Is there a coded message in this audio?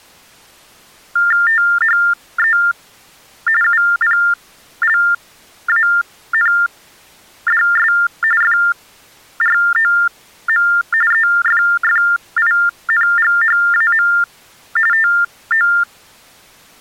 Yes: TTY/TDD text telephone tones (45.45 baud Baudot) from 1.2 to 15.8 s, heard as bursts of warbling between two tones, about 400 Hz shift, 1600 Hz centre. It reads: THE UPLANDS FROM EFFINGHAM TO